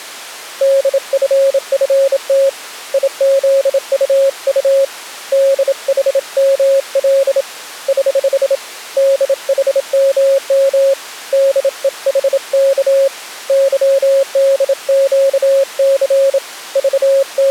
Morse code, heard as a keyed tone, hand-sent with a bug key, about 27 wpm, 550 Hz. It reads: DFFT IZUU DHML <HH> DHMM DEHK YDQC …